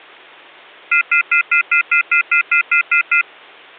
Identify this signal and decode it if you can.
Telephone call progress tone (North American plan), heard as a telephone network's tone, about 1400, 2050, 2450, 2600 Hz, 0.1 s on and 0.1 s off. Off-hook warning tone.